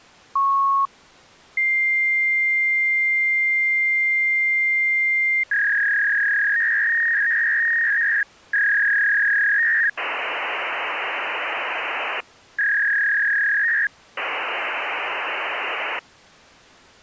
Fax machine handshake, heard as a beep, a long tone, a warble and hiss.